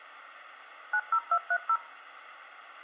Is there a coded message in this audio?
Yes: DTMF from 0.9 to 1.8 s, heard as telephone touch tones, dialled by machine, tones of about 60 ms, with phone line noise. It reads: 90230